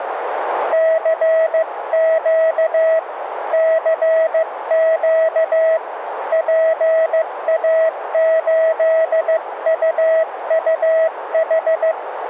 Morse code, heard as a keyed tone, hand-sent with a paddle, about 15 wpm, 650 Hz, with radio static and a narrow filter. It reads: CQ CQ PA8UUH